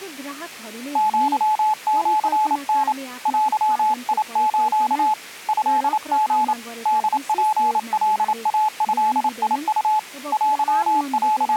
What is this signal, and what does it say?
Morse code (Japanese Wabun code), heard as a keyed tone, hand-sent with a paddle, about 28 wpm, 860 Hz, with speech in Nepali. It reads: アシタ デス トリ ホツカイドウ …